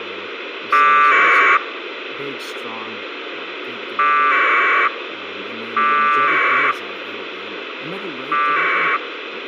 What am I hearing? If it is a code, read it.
Packet radio (AX.25, as in APRS), 1200 baud, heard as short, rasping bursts, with radio hiss and speech in English.